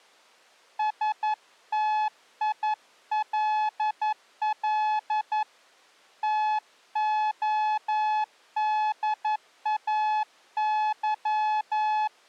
Morse code, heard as a keyed tone, hand-sent with a paddle, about 11 wpm, 860 Hz. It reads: STILL TODAY